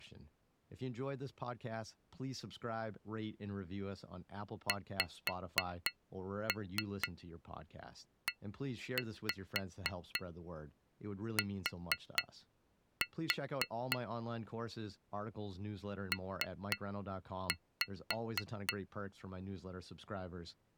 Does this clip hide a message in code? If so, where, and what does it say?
Yes: tap code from 4.7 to 18.8 s, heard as taps on glass, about 3 knocks a second, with speech in English. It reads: XET P